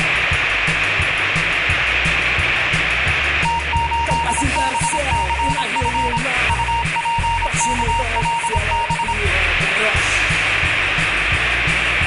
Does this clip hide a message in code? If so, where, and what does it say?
Yes: Morse code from 3.4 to 9.2 s, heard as a keyed tone, machine-sent, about 26 wpm, 930 Hz, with room echo. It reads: T8BCF UPKLB